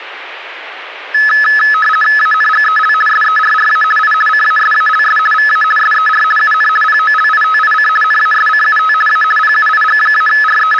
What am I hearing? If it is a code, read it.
RTTY (50 baud, 450 Hz shift), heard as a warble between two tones, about 1500 Hz centre. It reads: ANGEL SERRA I CASALS VA SER UN POLITIC NASCUT A …